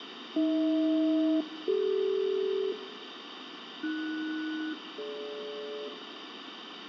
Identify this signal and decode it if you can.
Aircraft SELCAL, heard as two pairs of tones, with radio static, fading and a steady whistle near 1760 Hz. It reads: AH-CD AS-DG